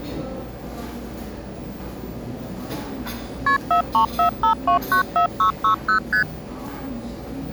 Multi-frequency trunk signalling (R1, as on North American trunks), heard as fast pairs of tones, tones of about 100 ms, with the noise of a cafe. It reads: KP 4345294660 ST